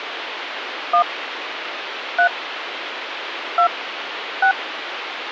DTMF, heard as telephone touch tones, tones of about 90 ms, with phone line noise. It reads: 1 3 2 6